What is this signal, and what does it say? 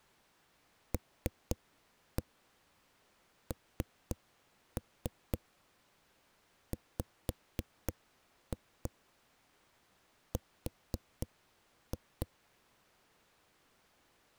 Tap code, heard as knocks on a wall, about 3 knocks a second. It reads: LNWR